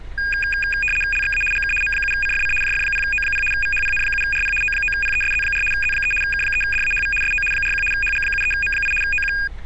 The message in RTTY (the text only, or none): LXA GK M7CFC JF0O0 VHPN7RP O9PESZ4 Z3 K3DAHV SO 41 HG73M8 OQ